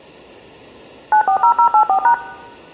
DTMF, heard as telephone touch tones, dialled by machine, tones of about 90 ms. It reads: 940084#